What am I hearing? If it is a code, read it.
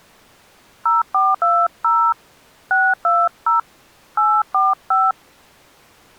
DTMF, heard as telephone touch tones, dialled by hand, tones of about 200 ms. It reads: 0420 620 845